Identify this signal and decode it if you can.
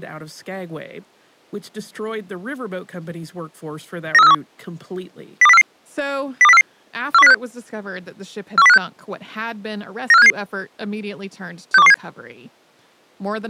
Five-tone selective call (EEA), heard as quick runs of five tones, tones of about 40 ms, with speech in English. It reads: 93431 02044 02044 41056 41056 94577 62117